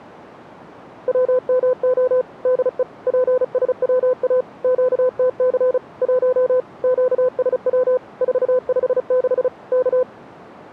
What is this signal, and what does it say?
Morse code, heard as a keyed tone, machine-sent, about 35 wpm, 510 Hz. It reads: WMO DE PSWA QTC 1 QSW 456 K